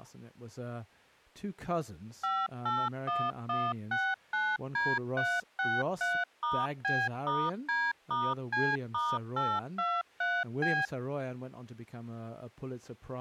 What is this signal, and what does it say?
DTMF, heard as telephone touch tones, dialled by machine, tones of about 230 ms, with speech in English. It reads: 581169D363*B*D*C*823B